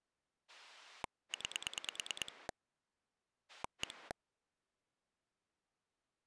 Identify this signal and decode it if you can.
Pulse dialling, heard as a rotary dial, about 9 pulses a second. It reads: 9 1